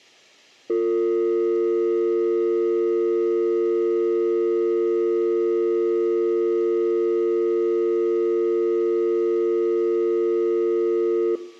Telephone call progress tone (North American or UK plan), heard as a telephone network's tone, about 350, 450 Hz, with room echo. Dial tone.